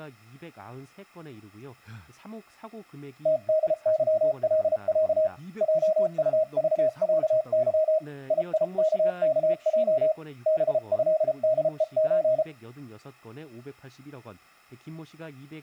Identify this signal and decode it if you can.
Morse code (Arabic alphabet), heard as a keyed tone, hand-sent with a paddle, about 33 wpm, 630 Hz, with speech in Korean. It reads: تدظلع جطضعظ ييككج بهدءز